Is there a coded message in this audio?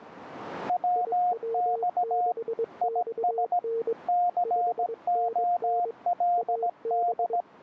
Yes: Morse code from 0.6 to 7.5 s, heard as two keyed tones. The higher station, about 17 wpm, 710 Hz: WX IS COLD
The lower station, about 22 wpm, 460 Hz: IW6XN 5NN AB